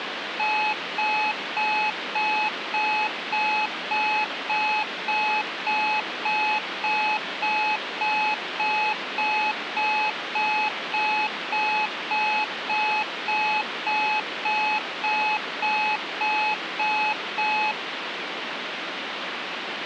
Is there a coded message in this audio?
No, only evenly repeated beeps, with phone line noise.